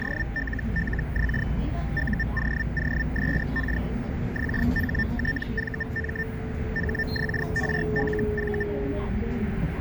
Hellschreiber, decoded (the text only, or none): … UOOSK XHTVM HXRLV